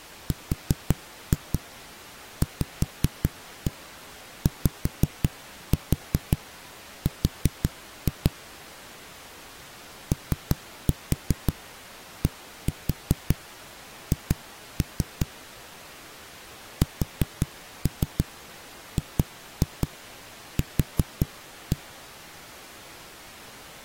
Tap code, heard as knocks on a wall, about 5 knocks a second. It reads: RVYR ODH SGQ